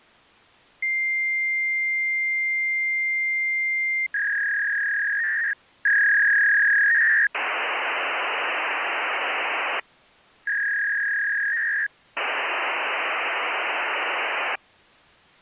Fax machine handshake, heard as a long tone, a warble and hiss.